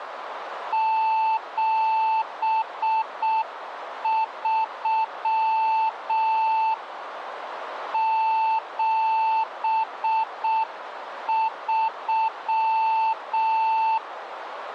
Morse code, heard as a keyed tone, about 6 wpm, 890 Hz, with radio static and a narrow filter. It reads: 73 73